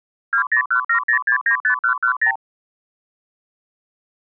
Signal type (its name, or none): multi-frequency trunk signalling